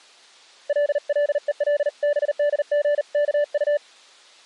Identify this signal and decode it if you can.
Morse code (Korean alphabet), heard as a keyed tone, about 39 wpm, 580 Hz. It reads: 깍듯이